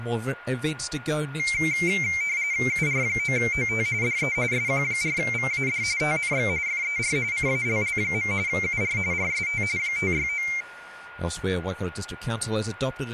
RTTY (45.45 baud, 170 Hz shift), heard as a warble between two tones, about 2200 Hz centre, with a steady whistle near 1430 Hz. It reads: UR9OT DE SQ4VAD TNX FER CALL. UR RST 569